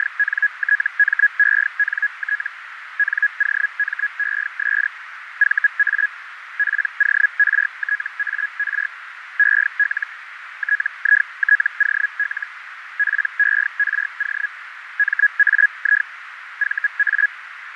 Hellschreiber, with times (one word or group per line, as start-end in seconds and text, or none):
0.0-2.5 …
3.0-4.9 NOMES
5.4-6.1 VA
6.6-8.9 PORTAR
9.4-10.1 EL
10.6-12.5 TITOL
13.0-14.5 PERO
15.0-16.1 MAI
16.6-17.3 VA